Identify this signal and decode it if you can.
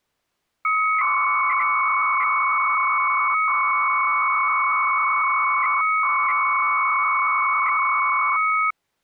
300-baud modem data (Bell 103 tones), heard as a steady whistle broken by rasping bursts, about 300 baud, 200 Hz shift.